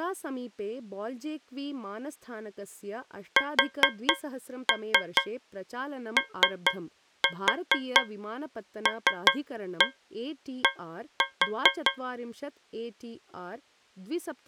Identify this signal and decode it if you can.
Tap code, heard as taps on a metal pipe, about 4 knocks a second, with speech in Sanskrit. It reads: SOLD